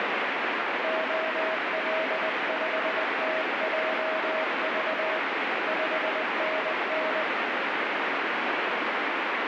Morse code, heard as a keyed tone, hand-sent with a paddle, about 20 wpm, 640 Hz, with heavy radio static. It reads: OL5TJV 5NN